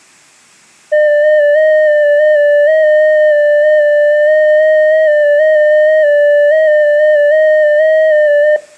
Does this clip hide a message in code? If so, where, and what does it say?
Yes: FT8 (one signal) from 0.9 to 8.6 s, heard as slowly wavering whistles, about 6.25 baud, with room echo.